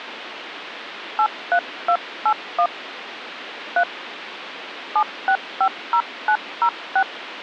DTMF, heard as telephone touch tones, dialled by hand, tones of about 70 ms, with phone line noise. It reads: 83281 3 7650906